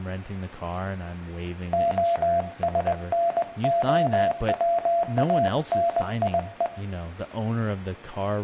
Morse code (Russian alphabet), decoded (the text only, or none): ОСНОВАНИЕ